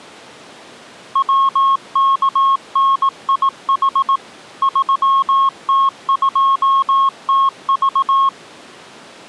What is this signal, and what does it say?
Morse code, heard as a keyed tone, machine-sent, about 18 wpm, 1090 Hz. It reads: WKNIH 3T2TV